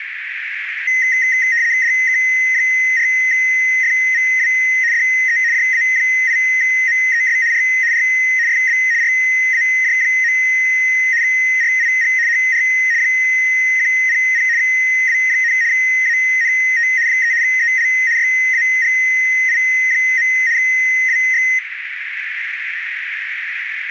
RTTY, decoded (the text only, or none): DK4FVW DE JA8MES R R FB RAJ. RIG HR 100 W, ANT 3 EL YAGI. WX